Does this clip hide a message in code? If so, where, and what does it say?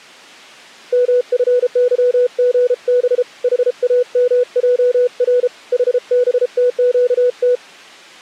Yes: Morse code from 0.9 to 7.6 s, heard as a keyed tone, hand-sent with a paddle, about 33 wpm, 490 Hz. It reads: MFYGB HAMJR HBTQT